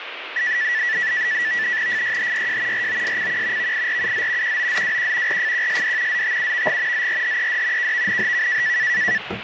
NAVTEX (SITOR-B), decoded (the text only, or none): FYHYJ ROSCQ VIRUZ QOZWQ RFQSD ZTUVG ZRHED KVNHK